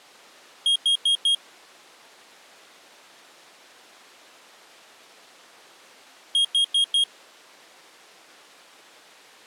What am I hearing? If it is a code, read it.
Alarm pattern, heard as an alarm's beeps, played twice, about 3250 Hz. Temporal four. Carbon monoxide.